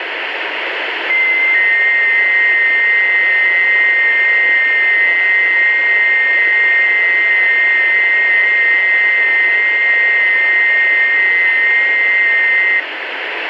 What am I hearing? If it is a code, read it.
FT8 (several signals at once), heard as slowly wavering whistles, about 6.25 baud, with radio static.